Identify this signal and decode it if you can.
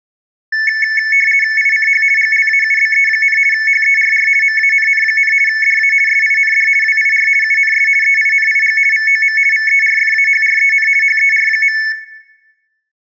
RTTY (50 baud, 450 Hz shift), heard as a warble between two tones, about 2000 Hz centre. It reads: ICH GLAUBE, HERR MANN, DA SIND WIR UNS EINIG VOM VERFAHREN HER.